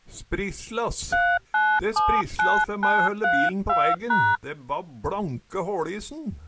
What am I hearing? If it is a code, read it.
DTMF, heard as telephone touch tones, dialled by hand, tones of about 250 ms. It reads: 3979932#